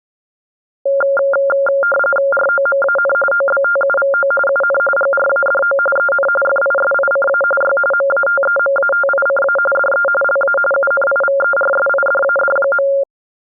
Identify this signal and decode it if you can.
RTTY (45.45 baud, 850 Hz shift), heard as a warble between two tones, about 980 Hz centre. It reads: ROMAN OBTUVO UN GRADO EN FISICA Y MATEMATICA DE LA UNIVERSIDAD.